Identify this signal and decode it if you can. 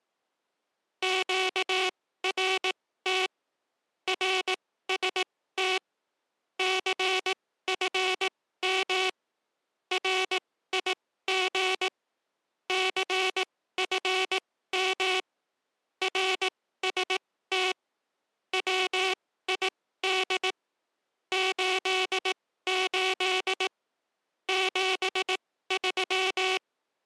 Morse code, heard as a buzzer, machine-sent, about 18 wpm, spaced as for 14 wpm. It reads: QRT RST CFM RIG CFM RST WID 88 73